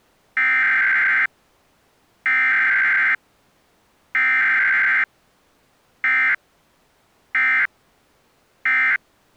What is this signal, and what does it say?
Emergency Alert System (SAME) tones (header bursts, then end-of-message bursts), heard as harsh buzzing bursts, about 520.83 baud.